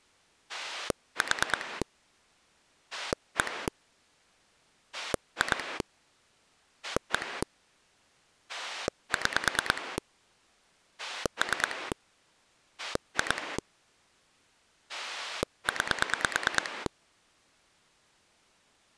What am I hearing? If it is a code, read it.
Pulse dialling, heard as a rotary dial, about 9 pulses a second. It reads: 4 1 2 1 6 3 2 9